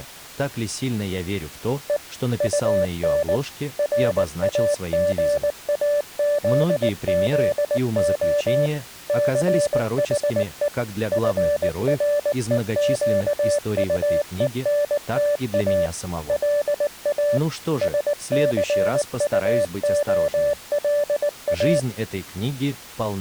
Morse code, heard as a keyed tone, machine-sent, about 19 wpm, 580 Hz. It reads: E UN RAGAZZO CHE FREQUENTA LA SCUOLA